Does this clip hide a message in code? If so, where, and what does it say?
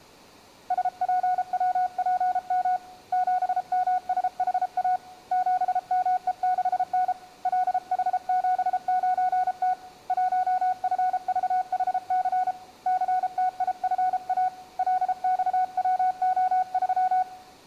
Yes: Morse code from 0.6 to 17.3 s, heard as a keyed tone, hand-sent with a paddle, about 33 wpm, 740 Hz. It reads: SPWPM 7MSHA 7ME6N LH79T 1FVHC CTIFA LXWO3